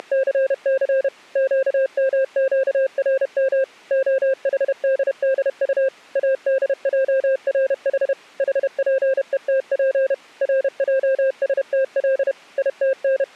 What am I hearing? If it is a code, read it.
Morse code (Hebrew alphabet), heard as a keyed tone, machine-sent, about 31 wpm, 530 Hz. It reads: … קמקרם החדדט אדערח חפותף רעשתל …